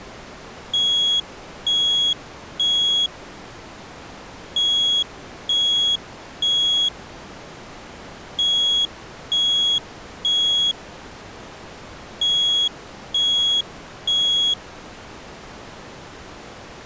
Alarm pattern, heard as an alarm's beeps, played four times, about 3350 Hz. Temporal three. Smoke or fire, evacuate.